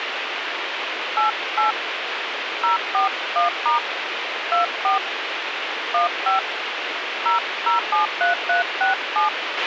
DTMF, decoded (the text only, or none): 88 041* 24 15 0073367